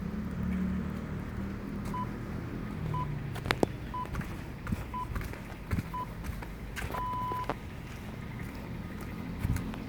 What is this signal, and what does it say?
Radio time signal (six pips, as the Greenwich Time Signal), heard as pips, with room echo and the noise of a residential street.